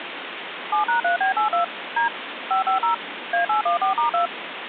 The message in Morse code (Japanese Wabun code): none

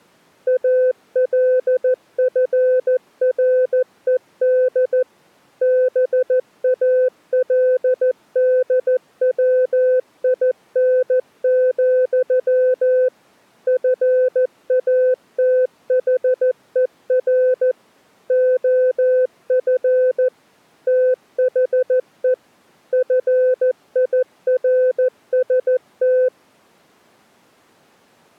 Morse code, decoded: ALFRED BALDWIN, FATHER OF THE FIRST

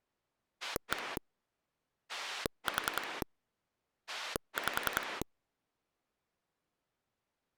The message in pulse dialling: 1 4 5

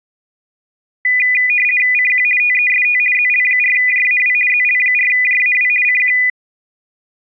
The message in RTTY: CQ TEST ZL4JAW ZL4JAW CQ

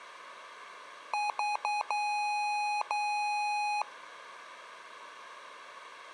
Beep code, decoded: 3 short, 2 long

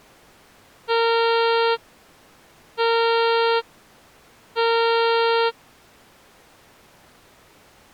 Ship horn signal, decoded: 3 short

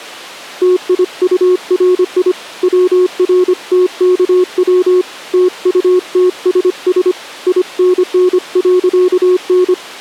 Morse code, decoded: TIURI WRTKW TUTSS INN.N

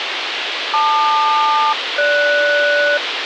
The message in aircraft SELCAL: LQ-GS

